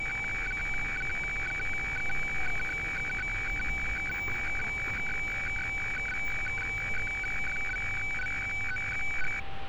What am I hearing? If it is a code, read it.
Weather fax (radiofax), 120 lines a minute, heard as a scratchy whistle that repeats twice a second, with radio static, a steady whistle near 780 Hz and street noise.